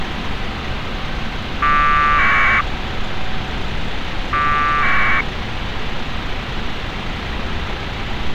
Packet radio (AX.25, as in APRS), 1200 baud, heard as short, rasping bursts, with radio hiss and street noise.